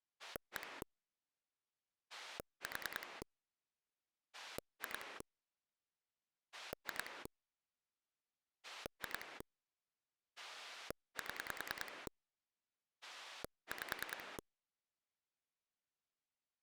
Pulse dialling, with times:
0.2-0.8 1
2.1-3.2 4
4.3-5.2 2
6.5-7.3 2
8.6-9.4 2
10.4-12.1 7
13.0-14.4 5

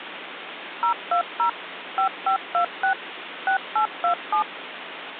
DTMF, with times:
0.8-1.5 020
2.0-2.9 5526
3.5-4.4 6827

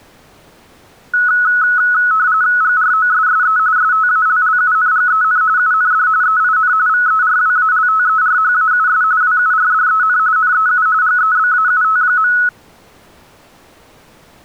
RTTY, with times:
2.6-3.6 GROSSE
3.8-5.4 STALLUNGEN
5.6-6.1 UND
6.2-6.7 EIN
6.9-9.0 VERWALTERHAUS
9.2-10.2 WURDEN
10.4-10.9 NEU
11.0-12.3 GEBAUT.

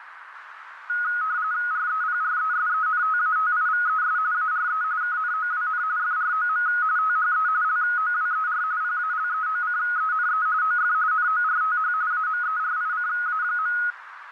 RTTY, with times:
1.7-4.2 REPRESENTATIVES
4.3-4.8 ARE
5.0-5.8 KNOWN
6.0-6.7 FROM
7.0-7.5 THE
7.6-8.6 LOWER
8.8-10.5 PALEOCENE
10.6-10.9 OF
11.1-11.9 NORTH
12.1-13.8 AMERICA.

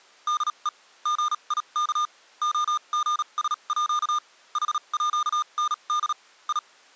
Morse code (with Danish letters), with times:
0.3-0.7 DE
1.1-2.1 GIK
2.4-4.2 OGSÅ
4.6-6.1 HÅND
6.5-6.6 I

